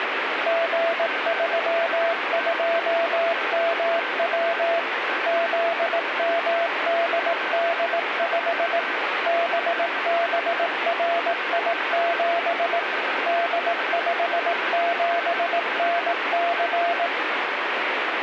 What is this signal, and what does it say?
Morse code, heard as a keyed tone, machine-sent, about 18 wpm, 680 Hz, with radio static and a weaker station near 1550 Hz. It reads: G32MW ZMDD5 BBRI7 D57NC